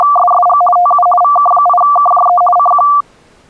RTTY (50 baud, 450 Hz shift), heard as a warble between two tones, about 930 Hz centre. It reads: … TU VK8KJE CQ